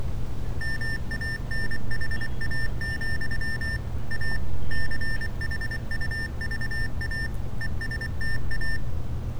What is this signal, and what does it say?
Morse code, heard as electronic beeps, machine-sent, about 24 wpm, 1800 Hz, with street noise. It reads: MANHA, A CHUVA ESTA